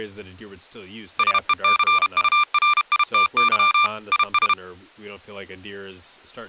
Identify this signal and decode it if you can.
Morse code, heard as electronic beeps, machine-sent, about 32 wpm, 1190 Hz, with speech in English. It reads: SECURITY IS